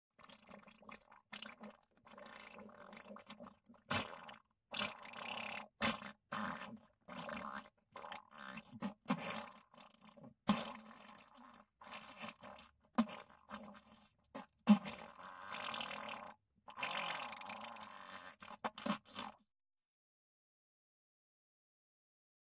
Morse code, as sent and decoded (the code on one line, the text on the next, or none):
none